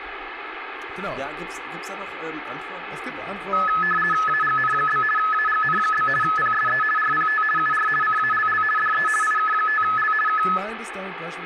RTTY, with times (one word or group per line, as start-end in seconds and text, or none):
4.3-5.0 AGN?
5.2-6.1 AGN?
6.2-6.8 PSE
7.0-7.4 RPT
7.6-7.9 UR
8.0-8.6 CALL
8.8-9.1 DE
9.2-10.1 IK5L
10.3-10.4 K